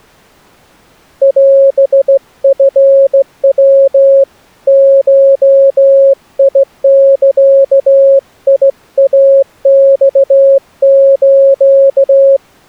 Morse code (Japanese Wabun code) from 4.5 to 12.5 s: ゴザイマス

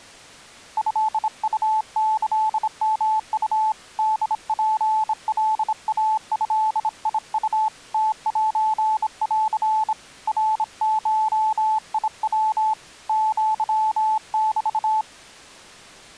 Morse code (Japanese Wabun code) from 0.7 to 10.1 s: トウキヨウ ホツカイドウ ムセン

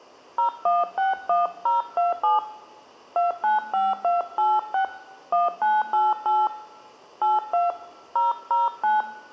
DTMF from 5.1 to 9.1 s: 1988 82 009

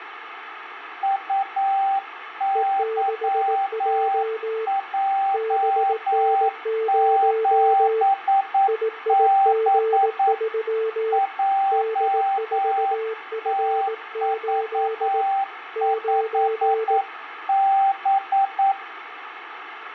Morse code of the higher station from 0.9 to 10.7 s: UYJ7B

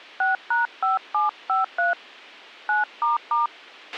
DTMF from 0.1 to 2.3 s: 6#5753

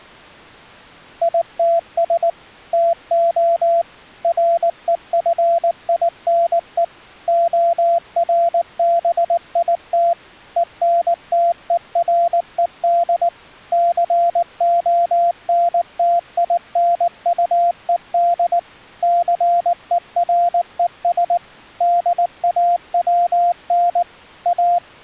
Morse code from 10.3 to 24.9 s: ENTERED CONTINUED CERES DAWN A

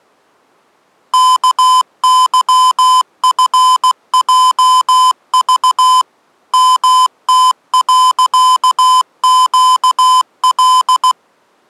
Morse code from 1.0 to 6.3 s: KYFJV

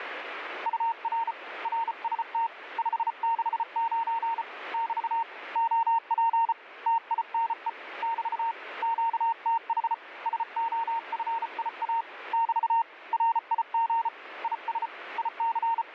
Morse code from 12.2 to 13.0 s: <BT>

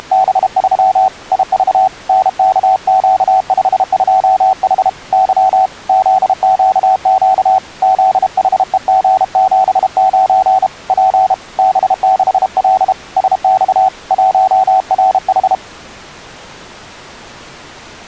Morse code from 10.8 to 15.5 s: P B6L SX 1RH

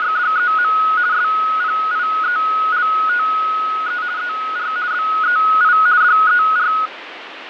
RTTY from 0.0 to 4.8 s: … SPIELTE ER

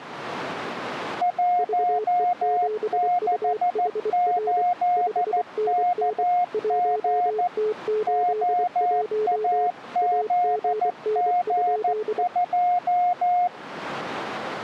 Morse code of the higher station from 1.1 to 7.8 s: 168KG

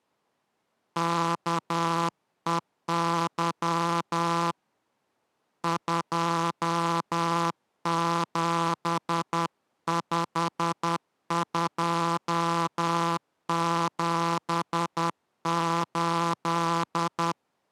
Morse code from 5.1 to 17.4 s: 275278

